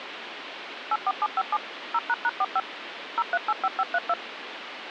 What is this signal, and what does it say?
DTMF, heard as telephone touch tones, dialled by machine, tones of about 40 ms, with phone line noise. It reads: 84757 0##45 0385532